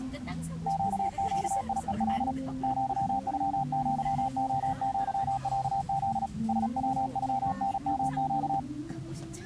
Morse code (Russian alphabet), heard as a keyed tone, hand-sent with a paddle, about 36 wpm, 790 Hz, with the noise of a park. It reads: ЩЩИЕЛ ЪЮЪОЪЯЗ СВЮНМЩ